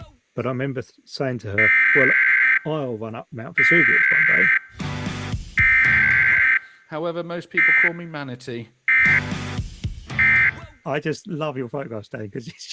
Emergency Alert System (SAME) tones (header bursts, then end-of-message bursts), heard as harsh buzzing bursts, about 520.83 baud.